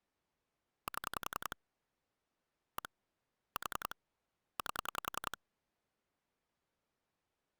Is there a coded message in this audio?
Yes: pulse dialling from 0.9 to 5.3 s, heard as clicks on a phone line, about 10 pulses a second. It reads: 7 1 4 8